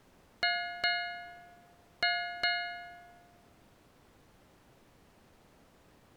Ship's bell, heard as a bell. 4. Four half-hours of the watch have passed.